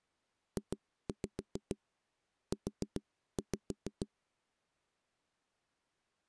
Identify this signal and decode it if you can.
Tap code, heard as knocks on a wall, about 7 knocks a second. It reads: JU